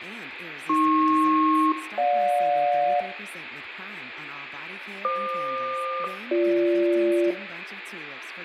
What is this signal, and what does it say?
Aircraft SELCAL, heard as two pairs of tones, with room echo and speech in English. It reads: AP-GJ FQ-BG